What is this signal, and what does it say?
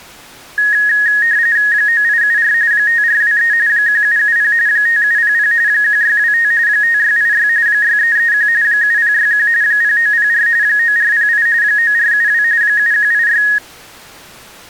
RTTY (45.45 baud, 170 Hz shift), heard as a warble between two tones, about 1750 Hz centre. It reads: 9874 5423 1770 5700 1625 5686 6331 7061 0904 9408 9472 7186